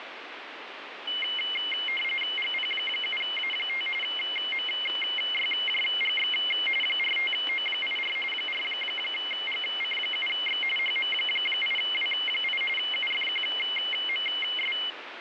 RTTY (45.45 baud, 850 Hz shift), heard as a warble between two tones, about 2550 Hz centre, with radio static. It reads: GP7A5 MYJGX 45O84 4GC7X HM8W8 UFQMS